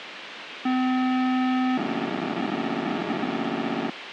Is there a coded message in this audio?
Yes: POCSAG pager data (512 baud) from 0.7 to 3.9 s, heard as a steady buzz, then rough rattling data, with radio hiss.